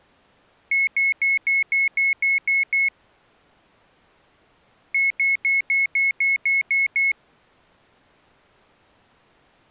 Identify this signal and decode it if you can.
Beep code, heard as beeps from a small speaker, played twice, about 2200 Hz. 9 short. In AMI BIOS tables: ROM checksum failure.